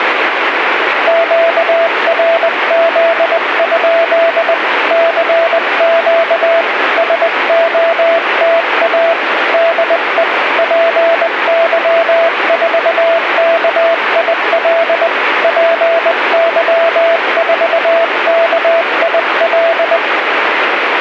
Morse code, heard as a keyed tone, hand-sent with a bug key, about 20 wpm, 670 Hz, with radio static. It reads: QRZ? CQ SOTA DE PY4KIL PY4KIL